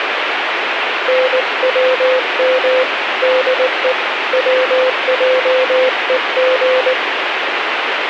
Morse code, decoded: NWM DE WJEG

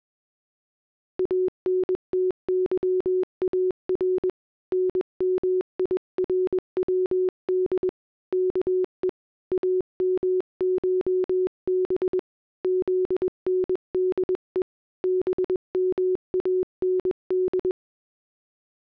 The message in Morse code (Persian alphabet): انتظار نمیرود که امشب زنده بماند

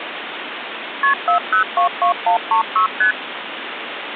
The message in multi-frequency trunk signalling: KP 4022136 ST

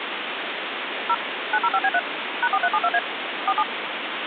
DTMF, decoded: 0 905B3 #4372A 47

